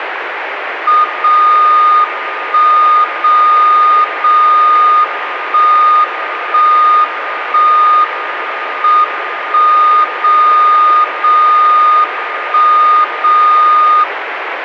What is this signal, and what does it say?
Radio time signal (WWVB), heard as a tone whose level steps once a second, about 1220 Hz, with radio static. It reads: 0 1 0 0 1 1 1 M 1 0 0 1 0